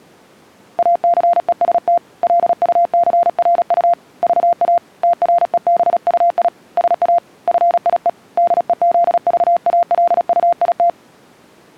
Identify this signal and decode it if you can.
Morse code, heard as a keyed tone, hand-sent with a paddle, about 36 wpm, 690 Hz. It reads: ACEST LUCRU VA TREBUI SA FIE DEZVALUIT